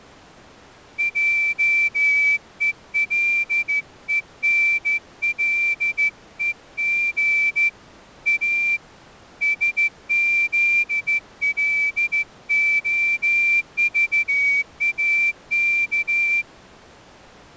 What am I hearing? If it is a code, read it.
Morse code, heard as a whistle, hand-sent with a straight key, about 14 wpm. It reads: JELENLEG A SZLOVAK